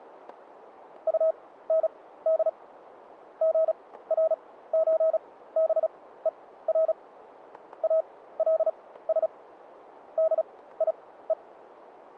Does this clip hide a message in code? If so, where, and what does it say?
Yes: Morse code (with German letters) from 1.0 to 11.4 s, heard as a keyed tone, machine-sent, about 36 wpm, spaced as for 17 wpm, 640 Hz, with static crashes. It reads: UND GRÖBER ALS DIE